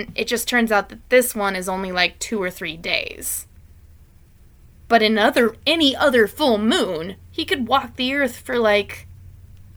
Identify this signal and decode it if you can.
Speech in English. There is no code.